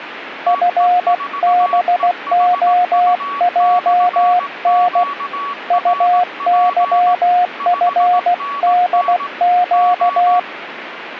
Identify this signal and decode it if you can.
Morse code, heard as a keyed tone, hand-sent with a paddle, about 16 wpm, 720 Hz, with radio static and a weaker station near 1130 Hz. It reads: FBOJN UYFDQ